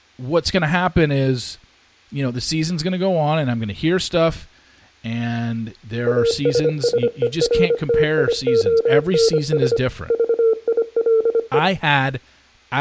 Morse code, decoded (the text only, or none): ASSERTIONS VILE